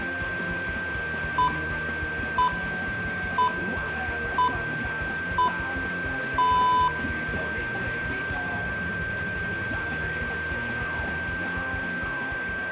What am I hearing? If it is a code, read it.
Radio time signal (six pips, as the Greenwich Time Signal), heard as pips, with a steady whistle near 1570 Hz and room echo.